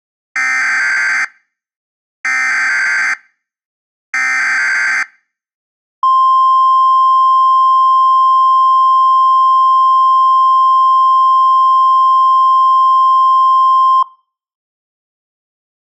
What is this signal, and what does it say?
Emergency Alert System (SAME) tones (header bursts, then the 1050 Hz attention tone), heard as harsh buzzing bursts, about 520.83 baud.